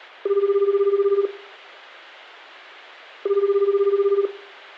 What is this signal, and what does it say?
Telephone call progress tone (Japanese plan), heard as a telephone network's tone, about 380, 400, 420 Hz, 1 s on and 2 s off, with hum and room echo. Ringback tone.